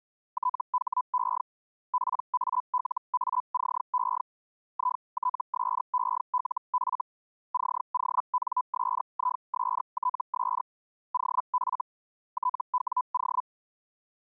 Hellschreiber (Feld-Hell, 122.5 baud), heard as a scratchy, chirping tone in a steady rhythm, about 1000 Hz. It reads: THE PALACE ITSELF CONSISTS OF TWO